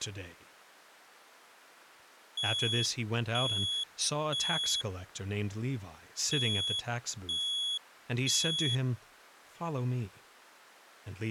Alarm pattern, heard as an alarm's beeps, played twice, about 3350 Hz, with speech in English. Temporal three. Smoke or fire, evacuate.